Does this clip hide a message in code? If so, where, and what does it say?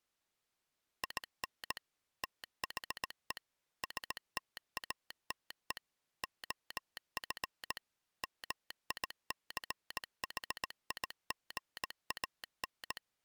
Yes: Morse code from 1.0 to 13.0 s, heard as a telegraph sounder, machine-sent, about 18 wpm. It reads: IN THE STATE OF MICHIGAN